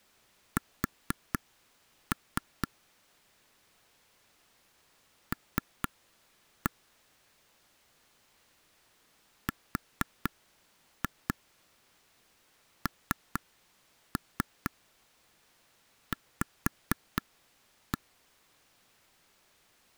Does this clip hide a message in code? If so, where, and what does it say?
Yes: tap code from 0.6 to 18.0 s, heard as taps on a table, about 4 knocks a second. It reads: S L RNV